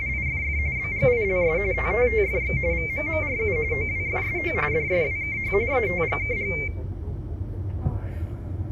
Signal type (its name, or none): RTTY